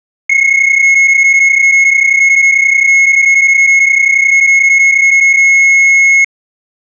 PSK31 (31.25 baud), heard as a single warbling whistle, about 2150 Hz.